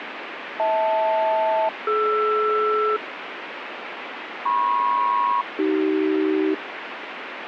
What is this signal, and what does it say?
Aircraft SELCAL, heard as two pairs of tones, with radio static. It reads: HL-DR MP-AC